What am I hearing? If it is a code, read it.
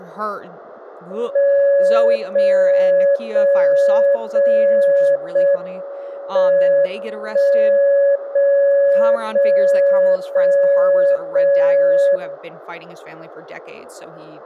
Radio time signal (JJY), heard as a tone whose level steps once a second, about 560 Hz, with speech in English. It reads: 0 0 0 0 M 1 0 0 0 0 0